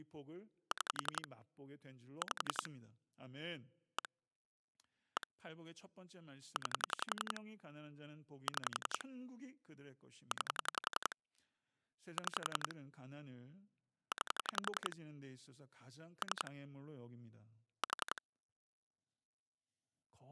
Pulse dialling, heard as clicks on a phone line, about 11 pulses a second, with speech in Korean. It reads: 6 5 1 1 9 6 9 6 9 3 4